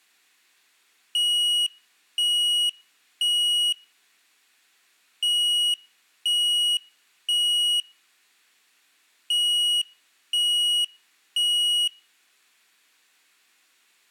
Alarm pattern, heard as an alarm's beeps, played three times, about 2900 Hz, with room echo. Temporal three. Smoke or fire, evacuate.